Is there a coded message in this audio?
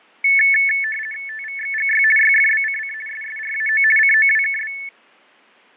Yes: RTTY (50 baud, 450 Hz shift) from 0.2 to 4.9 s, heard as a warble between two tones, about 2000 Hz centre, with fading. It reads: TVXGY YFBCC SSRAO COWKB